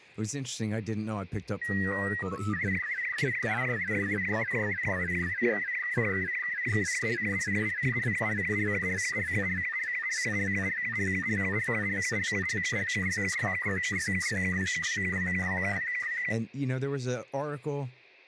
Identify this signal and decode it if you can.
SSTV (slow-scan television), Robot 72, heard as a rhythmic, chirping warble, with room echo and speech in English.